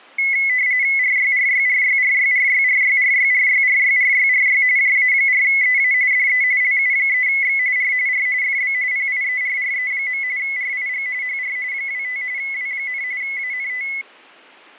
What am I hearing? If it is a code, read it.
RTTY (45.45 baud, 170 Hz shift), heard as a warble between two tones, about 2100 Hz centre, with fading. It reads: RYRYRYRYRYRYRYRYRYRYRY JA4EA DE LU3X R R FB PIERRE. RIG HR 25 W, ANT